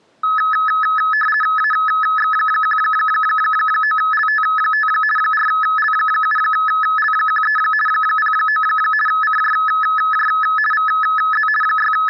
RTTY (50 baud, 450 Hz shift), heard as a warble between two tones, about 1500 Hz centre. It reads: AX19LT5 4L7L13 09 CJJ VZ …